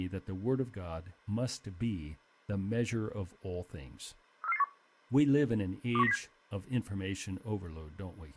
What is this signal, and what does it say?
Five-tone selective call (EEA), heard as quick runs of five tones, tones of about 40 ms, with speech in English. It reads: 34481 21907